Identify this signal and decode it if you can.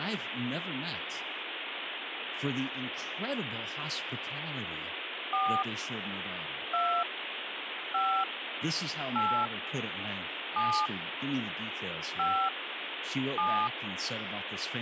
DTMF, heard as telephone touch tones, dialled by hand, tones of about 300 ms, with phone line noise and speech in English. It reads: 4 2 5 8 7 5 7